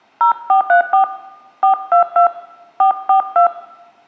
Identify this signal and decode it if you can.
DTMF, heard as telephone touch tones, dialled by hand, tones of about 110 ms, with room echo. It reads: 0434 422 442